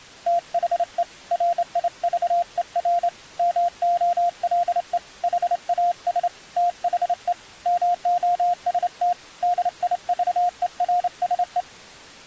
Morse code, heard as a keyed tone, hand-sent with a straight key, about 28 wpm, 700 Hz. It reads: THE RIVER MOLE HAS THE MOST DIVERSE